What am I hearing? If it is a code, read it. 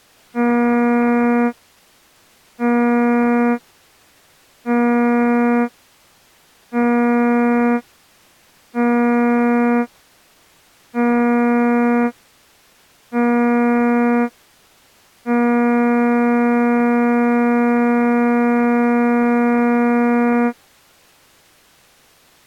Ship horn signal, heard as a ship's horn, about 240 Hz. 7 short, 1 long. At sea: general emergency alarm.